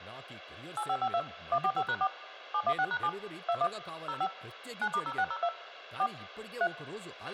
DTMF, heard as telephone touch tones, dialled by machine, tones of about 60 ms, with a squelch burst at the end and speech in Telugu. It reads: 8552 145#4 716#7 21 05 9*0602 4 3